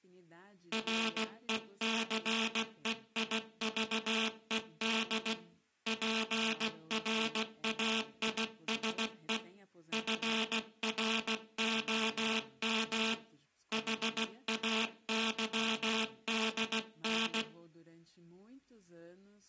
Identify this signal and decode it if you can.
Morse code, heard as a buzzer, hand-sent with a paddle, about 16 wpm, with speech in Portuguese. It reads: RECEIVED PRAISE FROM HAYDN